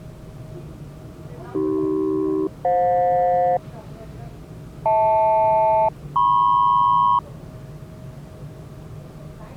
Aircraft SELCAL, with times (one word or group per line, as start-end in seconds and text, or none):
1.5-3.6 AC-FJ
4.9-7.2 HL-MP